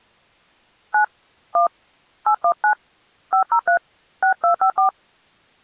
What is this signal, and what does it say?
DTMF, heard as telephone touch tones, dialled by hand, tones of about 90 ms. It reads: 9 1 819 503 6254